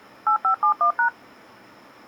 DTMF, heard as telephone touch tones, dialled by machine, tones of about 100 ms. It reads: 8571#